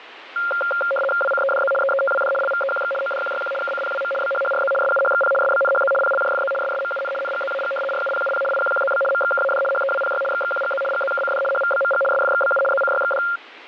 RTTY (75 baud, 850 Hz shift), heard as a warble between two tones, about 970 Hz centre, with radio static. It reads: WCEDZ EETWD LVEQX ODQYQ KCPWM BHHRZ SUHXP SBNHZ PLJFZ SSMUN NGZAG RUPUP IQQZB MXKAD HEWPY XXQGZ GZKCD HVBMG SFXBU ZCYXD